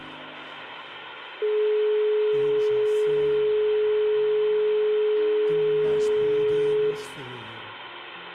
Telephone call progress tone (425 Hz plan, as in most of Europe), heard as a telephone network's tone, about 420 Hz, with phone line noise and room echo. Dial tone.